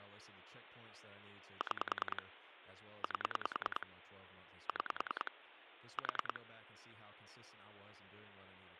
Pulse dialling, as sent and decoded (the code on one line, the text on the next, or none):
6 / 8 / 6 / 4
6 8 6 4